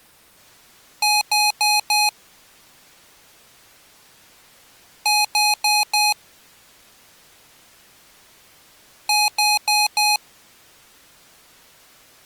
Beep code, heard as beeps from a small speaker, played three times, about 840 Hz. 4 short. In AMI BIOS tables: system timer failure; in Dell tables: memory read or write failure.